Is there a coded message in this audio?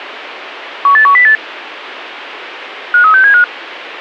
Yes: five-tone selective call (CCIR) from 0.9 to 3.4 s, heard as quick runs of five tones, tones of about 100 ms, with radio hiss. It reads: 18108 53675